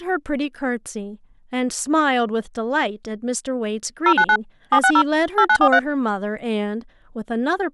DTMF, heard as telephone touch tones, dialled by machine, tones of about 70 ms, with speech in English. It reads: 099 760 8943